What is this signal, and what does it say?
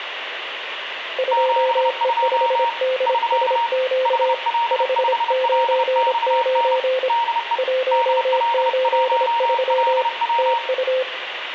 Morse code, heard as two keyed tones, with radio static and room echo. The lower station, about 26 wpm, 520 Hz: 2E5DSQ 599 183 TU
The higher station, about 30 wpm, 930 Hz: 72 <SK> HL5LXN DE DL1LW